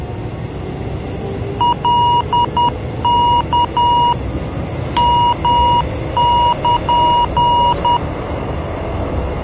Morse code (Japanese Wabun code), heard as electronic beeps, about 10 wpm, 960 Hz, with the noise inside a subway train. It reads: カワ ヨル